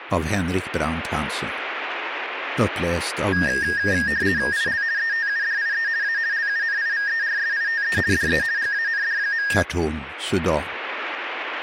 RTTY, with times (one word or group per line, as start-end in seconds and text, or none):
4.5-4.8 IL
5.0-5.9 ETUDIE
6.0-6.2 A
6.3-8.0 LUNIVERSITE
8.1-8.4 DE
8.6-9.5 GAND.